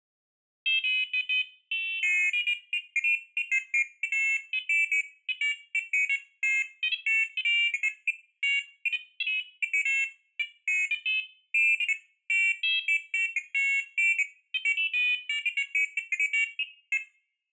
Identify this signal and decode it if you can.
Pairs of high tones at irregular times. There is no code.